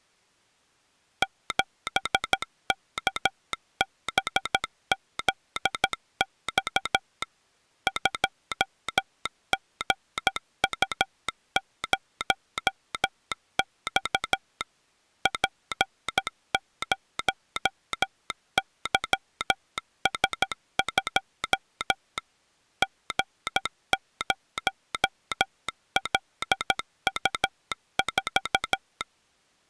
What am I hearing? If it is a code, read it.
Morse code, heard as a telegraph sounder, machine-sent, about 13 wpm. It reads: 7KBZX 2GU0X P0YS2 G0LU4